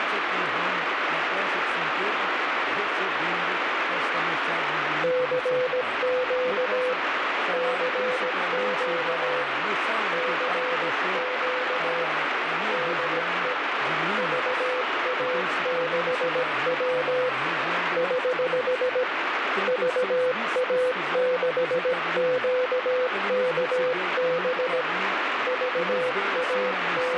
Morse code, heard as a keyed tone, hand-sent with a paddle, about 17 wpm, 500 Hz, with heavy radio static. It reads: CQ CQ CQ DE VA6W <HH> VA6QKB …